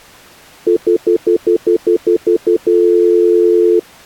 Telephone call progress tone (North American plan), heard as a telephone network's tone, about 350, 440 Hz, 0.1 s on and 0.1 s off. Stutter dial tone.